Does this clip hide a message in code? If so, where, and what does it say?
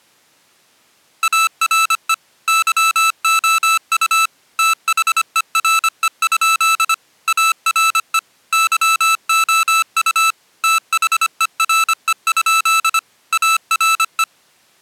Yes: Morse code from 1.2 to 14.3 s, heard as electronic beeps, machine-sent, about 25 wpm, 1320 Hz. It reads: ARE YOU THERE? ARE YOU THERE? ARE